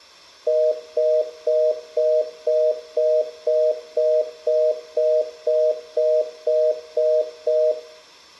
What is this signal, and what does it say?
Telephone call progress tone (North American plan), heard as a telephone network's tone, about 480, 620 Hz, 0.25 s on and 0.25 s off, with room echo. Congestion tone.